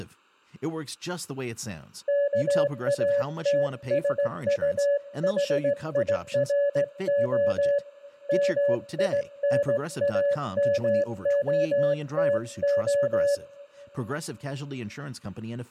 Morse code, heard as a keyed tone, hand-sent with a straight key, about 17 wpm, 570 Hz, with speech in English. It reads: KATSUHIRO MINAMOTO